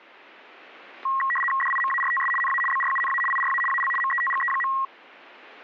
RTTY (75 baud, 850 Hz shift), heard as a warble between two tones, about 1500 Hz centre, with static crashes. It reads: DIMARTS NA BRUNA IRA AL METGE.